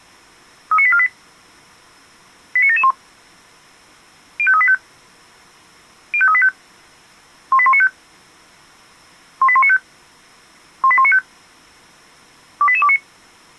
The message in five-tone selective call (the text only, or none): 39848 89771 05385 05385 18195 18195 18195 28829